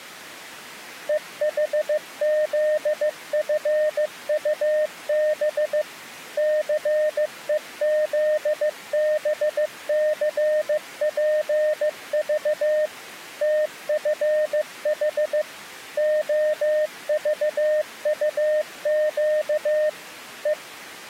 Morse code, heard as a keyed tone, machine-sent, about 15 wpm, 610 Hz. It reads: EHZFUB CEZBCPV TFH OVUQ E